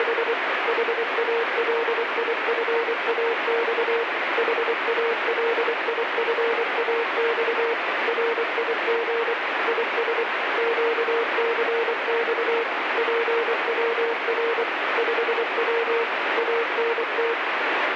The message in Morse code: … HALIFAX HALIFAX RIG IS QCX PWR 5W ANT

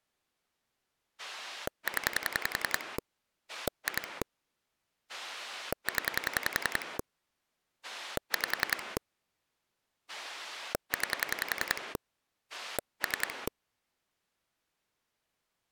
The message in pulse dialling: 0 2 0 5 9 3

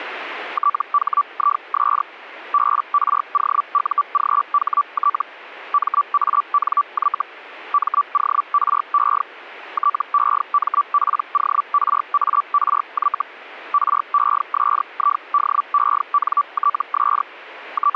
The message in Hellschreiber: THIS BROUGHT MANY MORE TEMPORARY RESIDENTS …

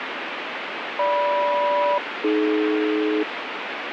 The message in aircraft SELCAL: GM-AD

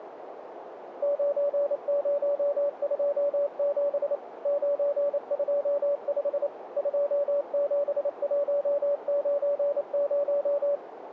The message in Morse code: 9027 925 27190

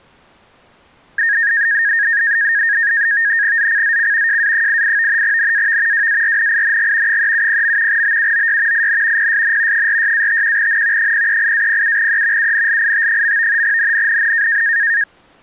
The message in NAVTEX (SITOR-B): ZCZC JA88 NAV WARNING 370. BUOY IN PSN 46-51N 038-07E UNLIT. NNNN

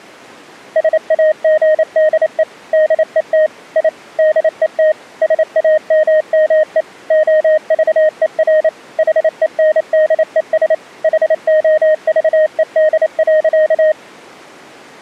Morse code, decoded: SAGDE DET I DET SAMME OVER HENDES HOVED.

